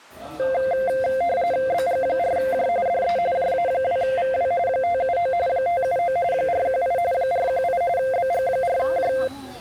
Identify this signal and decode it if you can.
RTTY (45.45 baud, 170 Hz shift), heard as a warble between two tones, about 610 Hz centre, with the noise of a restaurant. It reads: BG4J DE JA2VW 579 579 418 418 BG4J